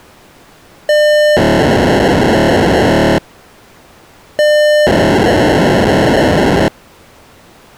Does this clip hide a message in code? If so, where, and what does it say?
Yes: POCSAG pager data (1200 baud) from 0.9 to 6.7 s, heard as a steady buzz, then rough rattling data.